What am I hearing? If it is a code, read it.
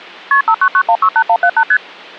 Multi-frequency trunk signalling (R1, as on North American trunks), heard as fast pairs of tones, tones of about 70 ms. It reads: KP 599168178 ST